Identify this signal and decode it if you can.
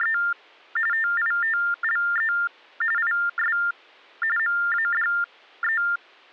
TTY/TDD text telephone tones (45.45 baud Baudot), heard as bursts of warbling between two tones, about 400 Hz shift, 1600 Hz centre. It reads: … TITLE IS MADE